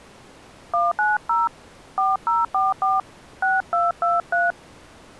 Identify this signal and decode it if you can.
DTMF, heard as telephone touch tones, dialled by hand, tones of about 180 ms. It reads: 190 4044 6223